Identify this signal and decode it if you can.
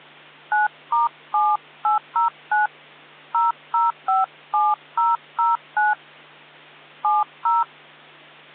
DTMF, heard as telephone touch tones, dialled by hand, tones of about 170 ms, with hum. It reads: 9*7809 0057009 70